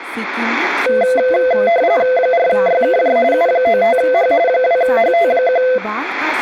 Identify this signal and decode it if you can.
RTTY (45.45 baud, 170 Hz shift), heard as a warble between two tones, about 600 Hz centre, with speech in Santali. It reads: 4YKJ U95H 2HT1